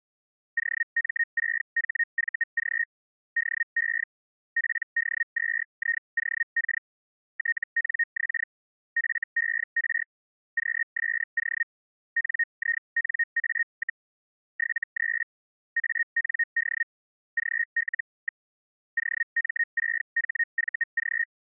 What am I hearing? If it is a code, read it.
Hellschreiber (Feld-Hell, 122.5 baud), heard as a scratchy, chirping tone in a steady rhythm, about 1850 Hz. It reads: OM6HVG DE PD2IOK TNX FER QSO NINA, 73 AND GL. OM6HVG